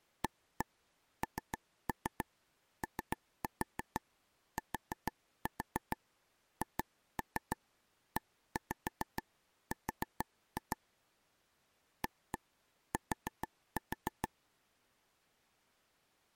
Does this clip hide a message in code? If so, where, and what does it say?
Yes: tap code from 0.2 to 14.3 s, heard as taps on a table, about 6 knocks a second. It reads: ANOTHER AT